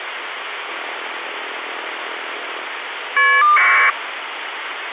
Caller ID data burst, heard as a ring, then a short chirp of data, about 1200 baud, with phone line noise.